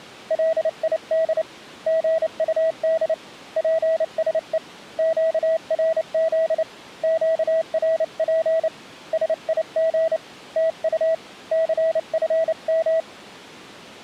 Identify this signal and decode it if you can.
Morse code, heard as a keyed tone, hand-sent with a paddle, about 29 wpm, 650 Hz. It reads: LID GUD PSE QRZ QRP SIG TU CFM